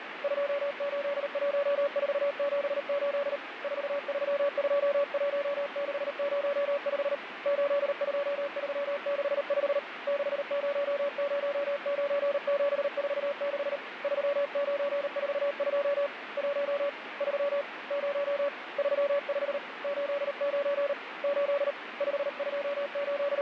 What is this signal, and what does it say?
Morse code, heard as a keyed tone, hand-sent with a paddle, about 38 wpm, 570 Hz, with radio static. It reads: 281478 4321605 82365 6009746 3942 1 3 0 35 89 8 …